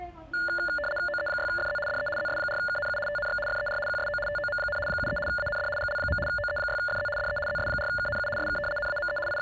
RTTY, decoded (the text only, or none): OE6FZ DE ZS4KNU TNX FER QSO TOM, 73 AND GL. OE6FZ DE ZS4KNU SK NAME …